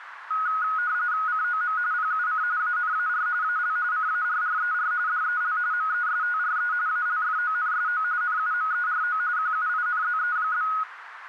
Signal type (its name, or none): RTTY